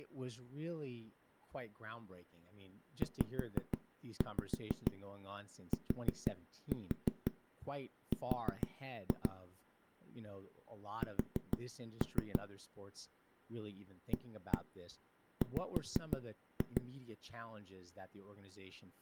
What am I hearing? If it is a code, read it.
Tap code, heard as knocks on a wall, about 6 knocks a second, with speech in English. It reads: ZTR S AW